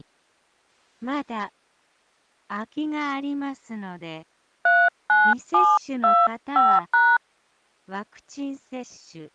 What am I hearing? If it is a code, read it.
DTMF, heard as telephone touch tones, dialled by hand, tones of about 230 ms. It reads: 39725#